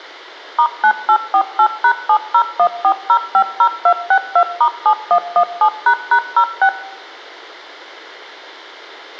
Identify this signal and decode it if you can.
DTMF, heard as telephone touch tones, dialled by machine, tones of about 80 ms, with a squelch burst at the end and room echo. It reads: *9848#7014050262*7117##06